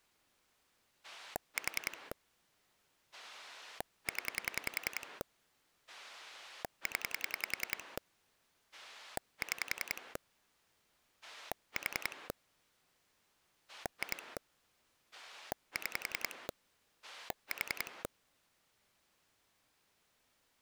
Pulse dialling, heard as a rotary dial, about 10 pulses a second. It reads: 4 0 0 6 4 2 6 4